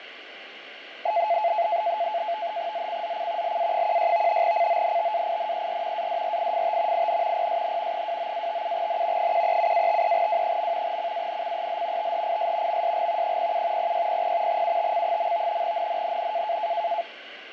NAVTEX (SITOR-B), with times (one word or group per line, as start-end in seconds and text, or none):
2.7-3.6 ZCZC
3.4-4.4 LA16
4.4-6.1 CONTAINER
6.0-7.1 ADRIFT
6.9-7.5 IN
7.4-8.1 PSN
7.9-9.3 29-57N
9.2-11.0 137-53W.
10.9-12.1 CANCEL
12.0-12.8 THIS
12.7-13.4 MSG
13.2-13.9 07
13.8-14.6 0600
14.5-15.6 UTC.
15.6-16.6 NNNN